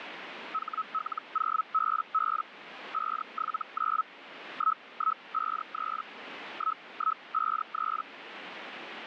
Hellschreiber (Feld-Hell, 122.5 baud), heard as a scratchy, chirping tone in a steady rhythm, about 1290 Hz, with radio static. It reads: HL0BB 579 1153 1153